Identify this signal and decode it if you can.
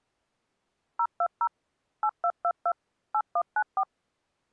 DTMF, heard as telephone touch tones, dialled by machine, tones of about 60 ms. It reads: 020 8222 8194